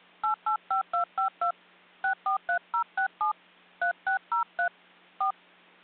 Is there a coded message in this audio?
Yes: DTMF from 0.2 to 5.3 s, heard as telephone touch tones, dialled by hand, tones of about 110 ms. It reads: 885252 643067 3603 4